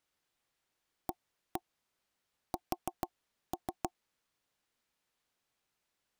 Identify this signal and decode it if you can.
Tap code, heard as knocks on wood, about 6 knocks a second. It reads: AS